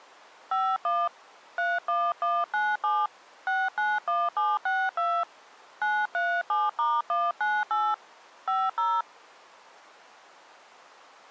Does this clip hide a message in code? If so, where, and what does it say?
Yes: DTMF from 0.5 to 9.0 s, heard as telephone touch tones, dialled by hand, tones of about 230 ms. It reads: 51 31197 691762 937*198 50